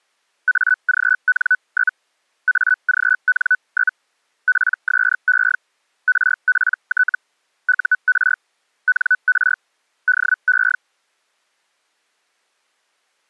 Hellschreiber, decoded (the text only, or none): AGN? AGN? PSE RPT UR NR DE